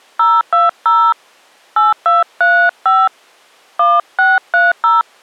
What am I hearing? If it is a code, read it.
DTMF, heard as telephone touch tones, dialled by hand, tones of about 200 ms. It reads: 020 8235 1630